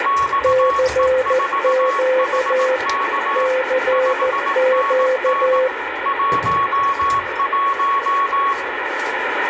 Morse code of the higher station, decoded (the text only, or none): XE4HK 5NN 11